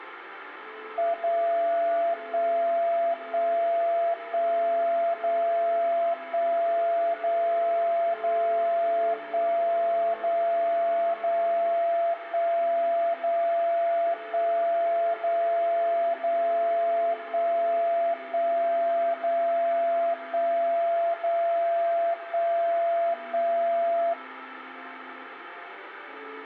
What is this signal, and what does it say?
Radio time signal (DCF77), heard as a tone whose level steps once a second, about 680 Hz. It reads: 0 1 1 1 0 1 0 0 1 0 0 1 0 1 0 0 1 1 0 1 0 1 1